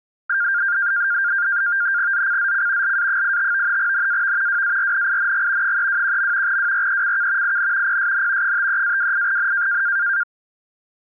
NAVTEX (SITOR-B), 100 baud, 170 Hz shift, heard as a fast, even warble, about 1500 Hz centre. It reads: ZCZC LA85 NAV WARNING 321. WRECK IN PSN 53-28N